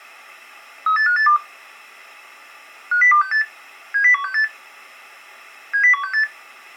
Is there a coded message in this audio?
Yes: five-tone selective call (CCIR) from 0.9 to 6.2 s, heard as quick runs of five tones, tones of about 100 ms. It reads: 38582 50268 70168 70168